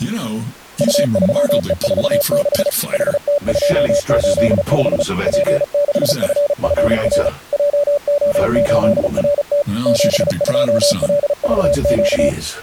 Morse code, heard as a keyed tone, machine-sent, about 35 wpm, 580 Hz. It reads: U3E46 HT285 P6FFR JO8RT 72LVQ